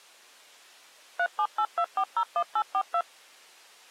DTMF, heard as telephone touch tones, dialled by machine, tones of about 70 ms. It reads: 3782401842